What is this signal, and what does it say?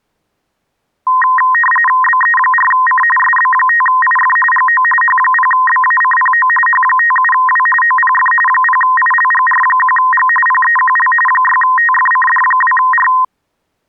RTTY (45.45 baud, 850 Hz shift), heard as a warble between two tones, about 1450 Hz centre. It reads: BE4C SB5IF GO H0BACPO H57W OPF 0ILGR1G PEQL 6TFCD2R